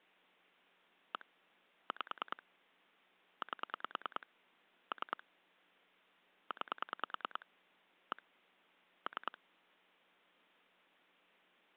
Pulse dialling, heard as clicks on a phone line, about 9 pulses a second. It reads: 1 5 8 3 9 1 3